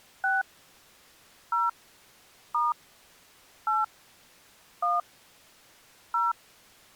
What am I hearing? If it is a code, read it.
DTMF, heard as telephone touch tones, dialled by hand, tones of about 180 ms. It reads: 6 0 * 8 1 0